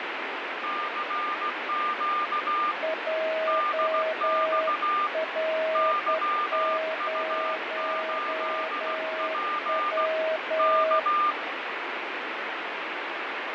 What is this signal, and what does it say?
Morse code, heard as two keyed tones, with heavy radio static and fading. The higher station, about 16 wpm, 1200 Hz: CQ DX YU8P K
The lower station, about 10 wpm, 640 Hz: JR0W